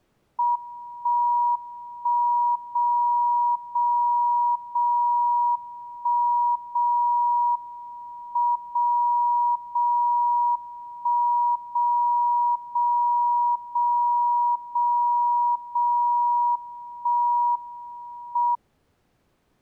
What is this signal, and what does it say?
Radio time signal (WWVB), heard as a tone whose level steps once a second, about 960 Hz. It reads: 1 1 0 0 0 1 0 M 0 0 1 0 0 0 0 0 1 M